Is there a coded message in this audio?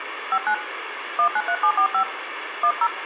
Yes: DTMF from 0.3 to 2.9 s, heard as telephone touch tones, dialled by hand, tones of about 70 ms, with phone line noise. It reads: 59 193745 10